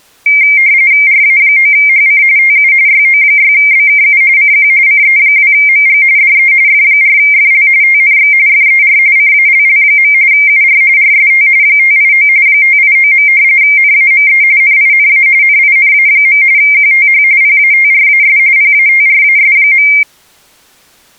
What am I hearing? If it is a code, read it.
RTTY (45.45 baud, 170 Hz shift), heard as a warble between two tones, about 2200 Hz centre. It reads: RA9HC TU YO6BKU CQ CE2MG DE F4FL TNX FER CALL. UR RST 589 589. NAME NINA NINA. QTH PATRAS PATRAS.